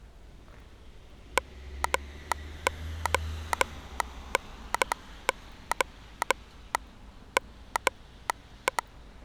Morse code (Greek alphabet), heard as a telegraph sounder, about 12 wpm, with street noise. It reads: ΜΟΝΟ ΜΕ